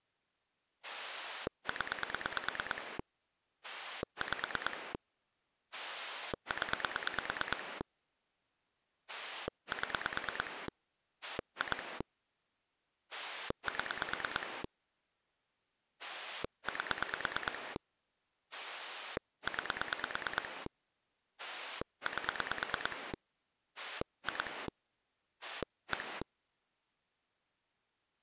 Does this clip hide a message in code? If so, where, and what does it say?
Yes: pulse dialling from 0.8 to 26.2 s, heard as a rotary dial, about 9 pulses a second. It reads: 0 5 0 7 2 7 8 9 8 2 1